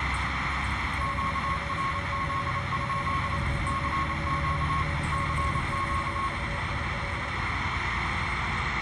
Morse code, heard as two keyed tones, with radio static, room echo and the noise inside a bus. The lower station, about 30 wpm, 570 Hz: LF0G12 NCQUIL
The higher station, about 28 wpm, 1090 Hz: QRZ? CQ CQ